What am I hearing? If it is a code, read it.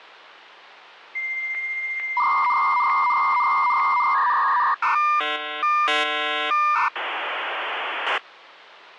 Dial-up modem handshake (V.34 or later), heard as a whistle, warbles, then hiss, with hum.